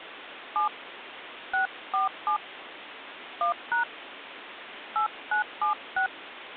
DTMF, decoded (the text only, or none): 7 647 1# 8976